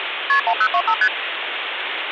Multi-frequency trunk signalling (R1, as on North American trunks), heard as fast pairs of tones, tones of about 70 ms, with phone line noise. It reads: KP 1025 ST